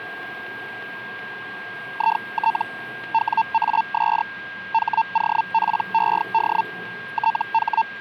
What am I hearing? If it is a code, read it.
Hellschreiber (Feld-Hell, 122.5 baud), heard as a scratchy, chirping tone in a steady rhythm, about 900 Hz, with a steady whistle near 1610 Hz and street noise. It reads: IT WAS HOPED …